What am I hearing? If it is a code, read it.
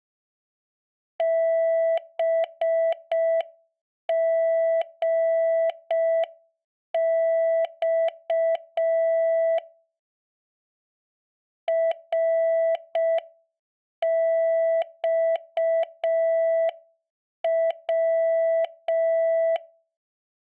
Morse code, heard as a keyed tone, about 5 wpm, 660 Hz. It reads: BGX RXW